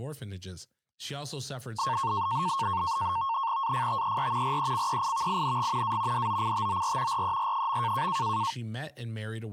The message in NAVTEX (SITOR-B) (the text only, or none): AFTER RECEIVING A DOCTOR RER.